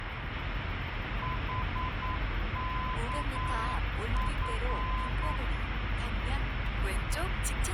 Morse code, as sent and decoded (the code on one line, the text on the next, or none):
.... -.- ..-.
HKF